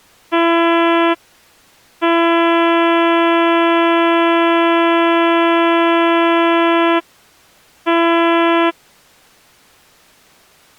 Ship horn signal, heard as a ship's horn, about 340 Hz. 1 short, 1 long, 1 short. At sea: a vessel at anchor warns of its position.